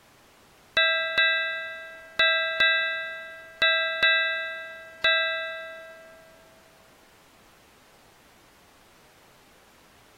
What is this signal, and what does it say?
Ship's bell, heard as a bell. 7. Seven half-hours of the watch have passed.